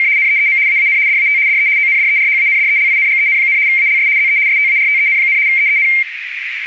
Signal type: RTTY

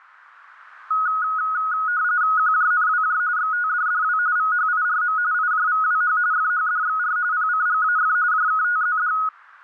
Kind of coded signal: RTTY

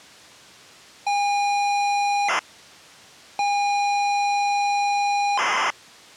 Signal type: ZX Spectrum tape loading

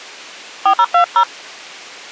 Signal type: DTMF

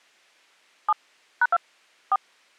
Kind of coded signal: DTMF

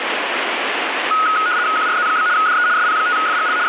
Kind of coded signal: RTTY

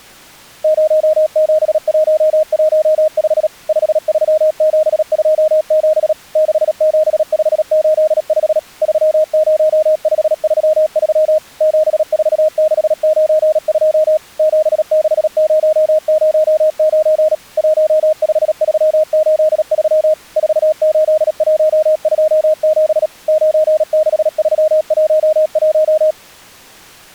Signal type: Morse code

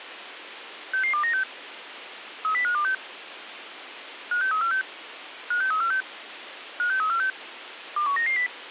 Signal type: five-tone selective call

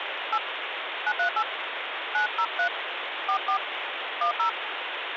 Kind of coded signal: DTMF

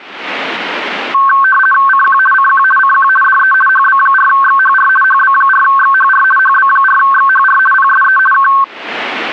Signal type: RTTY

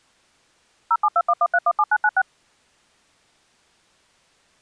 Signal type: DTMF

